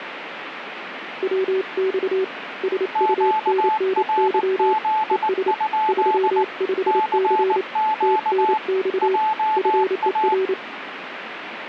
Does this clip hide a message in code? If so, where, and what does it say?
Yes: Morse code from 1.2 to 10.6 s, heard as two keyed tones, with radio static. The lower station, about 28 wpm, 380 Hz: WX SUNNY ES 35C TNX FER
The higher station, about 19 wpm, 870 Hz: QRZ? CQ JA